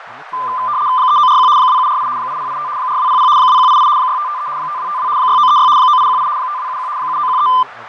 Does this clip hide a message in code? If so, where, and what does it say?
Yes: RTTY (75 baud, 170 Hz shift) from 0.3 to 7.6 s, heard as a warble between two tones, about 1100 Hz centre, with radio static, fading, a narrow filter and speech in English. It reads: 3941 2748 8085 4200 2188 6553 5252 6936 9818 5271 7913